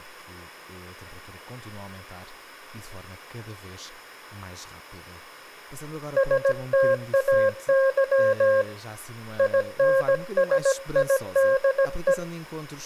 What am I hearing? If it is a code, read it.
Morse code, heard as a keyed tone, hand-sent with a paddle, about 17 wpm, 540 Hz, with room echo and speech in Portuguese. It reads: STAY INSIDE